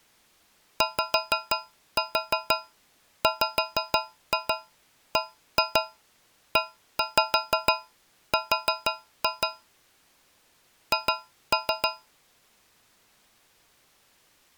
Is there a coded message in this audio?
Yes: tap code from 0.8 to 12.1 s, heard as taps on a metal pipe, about 6 knocks a second. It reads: YWBER H